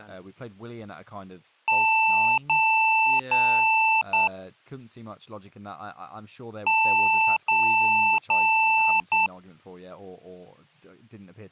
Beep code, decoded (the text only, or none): 3 long, 1 short